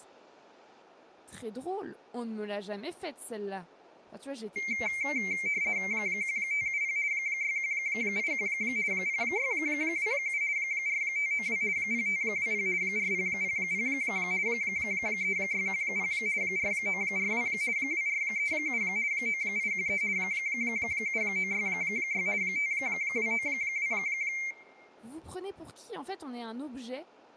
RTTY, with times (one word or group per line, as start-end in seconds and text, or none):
5.9-7.0 1570
7.1-8.5 6181
8.9-10.4 0627
10.6-11.6 4592
11.8-12.7 0520
12.8-13.9 4000
14.5-16.1 3610
16.4-17.5 4942
17.8-18.8 2437
19.1-20.0 9813
20.2-22.3 7966
22.4-23.9 5292